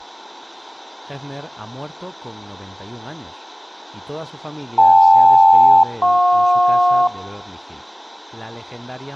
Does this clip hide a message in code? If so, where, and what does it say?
Yes: aircraft SELCAL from 4.8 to 7.1 s, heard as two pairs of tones, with room echo and speech in Spanish. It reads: KL-JP